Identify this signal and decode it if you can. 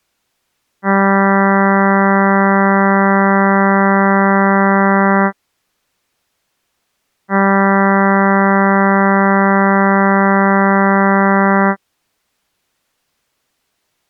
Ship horn signal, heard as a ship's horn, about 200 Hz. 2 long. At sea: a vessel under power that has stopped in fog.